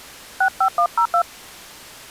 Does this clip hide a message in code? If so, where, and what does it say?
Yes: DTMF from 0.4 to 1.2 s, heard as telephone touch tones, dialled by hand, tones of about 80 ms. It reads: 65102